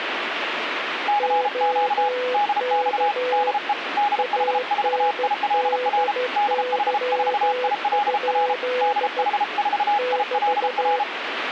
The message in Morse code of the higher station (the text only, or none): CQ DX DE DH4ILR DH4ILR DH4ILR